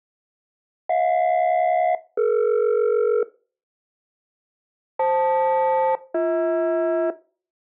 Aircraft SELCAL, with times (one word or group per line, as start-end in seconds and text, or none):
0.9-3.2 HJ-DE
5.0-7.1 FL-BH